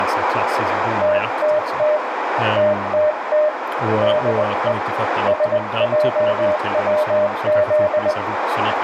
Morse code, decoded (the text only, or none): TTT TTT DE SJWZ